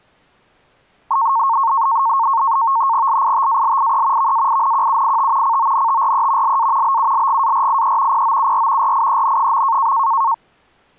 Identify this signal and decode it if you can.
NAVTEX (SITOR-B), 100 baud, 170 Hz shift, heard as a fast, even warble, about 1000 Hz centre. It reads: LITALIE VAINQUIT CONTRE LA BULGARIE POUR RIEN.